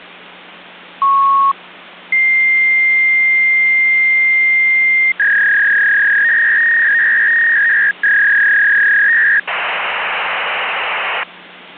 Fax machine handshake, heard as a beep, a long tone, a warble and hiss.